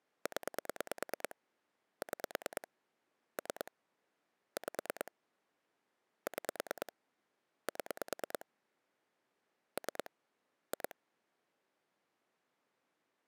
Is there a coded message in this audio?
Yes: pulse dialling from 0.3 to 10.9 s, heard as clicks on a phone line, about 9 pulses a second. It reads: 0 6 3 5 6 7 3 2